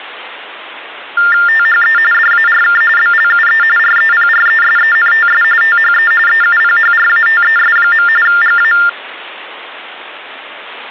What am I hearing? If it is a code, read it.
TTY/TDD text telephone tones (45.45 baud Baudot), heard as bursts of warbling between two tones, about 400 Hz shift, 1600 Hz centre. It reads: THE DARK BLUE REPRESENTS THE EUPHRATES. GA